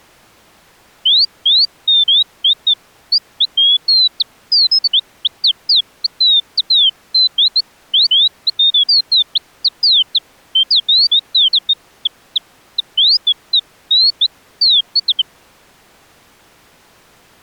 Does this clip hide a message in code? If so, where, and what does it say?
No, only bird-like chirps.